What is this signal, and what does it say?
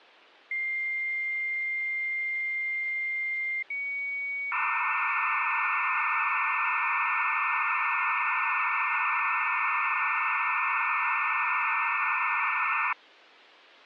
Dial-up modem handshake (low-speed, two carriers), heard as two whistles, then hiss.